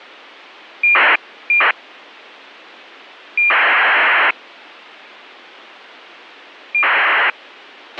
ACARS aircraft data, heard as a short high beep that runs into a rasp, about 2400 baud, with a squelch burst at the end.